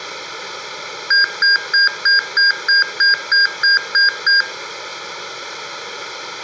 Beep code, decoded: 11 short

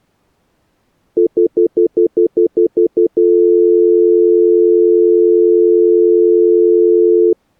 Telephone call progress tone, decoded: stutter dial tone

